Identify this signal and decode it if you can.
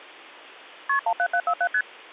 Multi-frequency trunk signalling (R1, as on North American trunks), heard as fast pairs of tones, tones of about 70 ms. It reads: KP 17747 ST